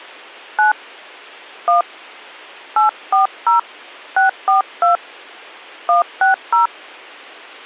DTMF, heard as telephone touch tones, dialled by hand, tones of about 130 ms. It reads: 9 1 840 642 160